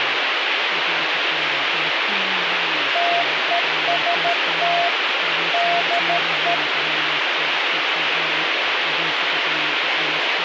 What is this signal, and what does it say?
Morse code, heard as a keyed tone, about 13 wpm, 690 Hz, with radio hiss and speech in Czech. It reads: TEST DE